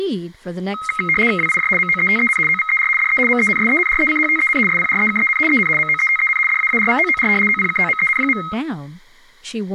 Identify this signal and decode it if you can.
RTTY (75 baud, 850 Hz shift), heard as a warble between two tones, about 1700 Hz centre, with speech in English. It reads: WIJ MOETEN OVER DE MENSENRECHTEN SPREKEN EN MOETEN DAARVOOR OPKOMEN.